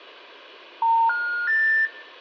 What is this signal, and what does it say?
Telephone call progress tone (North American plan), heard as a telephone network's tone, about 910, 1430, 1800 Hz, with room echo. Special information tone.